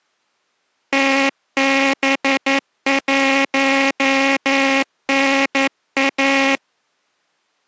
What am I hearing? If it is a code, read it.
Morse code, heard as a buzzer, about 11 wpm. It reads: TB1NA